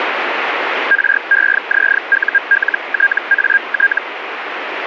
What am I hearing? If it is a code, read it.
Hellschreiber (Feld-Hell, 122.5 baud), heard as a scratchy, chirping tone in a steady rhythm, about 1600 Hz, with radio static. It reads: REZULTAT